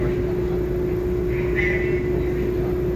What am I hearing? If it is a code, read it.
The noise inside a subway train. There is no code.